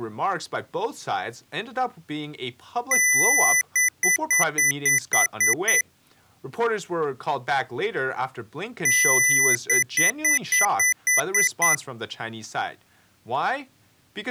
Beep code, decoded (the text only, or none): 1 long, 8 short